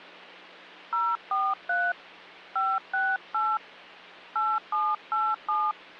DTMF, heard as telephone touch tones, dialled by hand, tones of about 230 ms, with hum. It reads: 043 568 8787